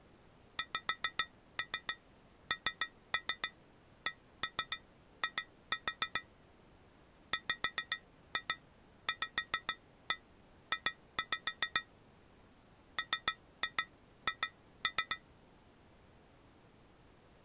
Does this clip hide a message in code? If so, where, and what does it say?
Yes: tap code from 0.6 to 15.2 s, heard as taps on glass, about 7 knocks a second. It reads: XNCI WVJ MH